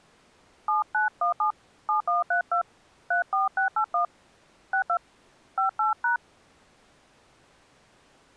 DTMF, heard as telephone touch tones, dialled by hand, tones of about 110 ms. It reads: 7917 7132 34681 62 58#